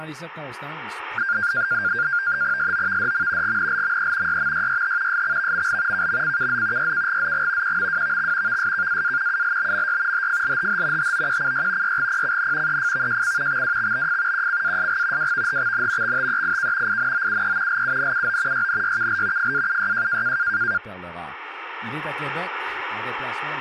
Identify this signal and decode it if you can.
NAVTEX (SITOR-B), 100 baud, 170 Hz shift, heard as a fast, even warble, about 1500 Hz centre, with speech in French. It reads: SOVDM GNLME YMYYH SXVML KMCKZ YKGZG QMWVX VSKAA ULBMY HFLHH HOQCY YGPCN EFVJC XWXBF QCASG WVHXN XTEIK INOUE LUNUO YNYKL FAUYJ